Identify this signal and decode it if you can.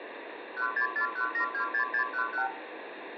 Multi-frequency trunk signalling (R2, with the far end's replies), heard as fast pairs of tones, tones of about 100 ms, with phone line noise and room echo. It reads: 1641726611